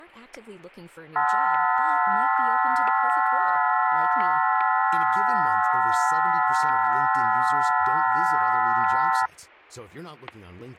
FT8 (several signals at once), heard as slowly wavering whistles, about 6.25 baud, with static crashes and speech in Spanish.